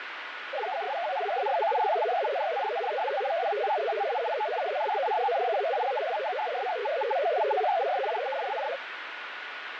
Multi-tone FSK (Olivia or MFSK type), about 500 Hz wide, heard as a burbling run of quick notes, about 62.5 baud, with radio static.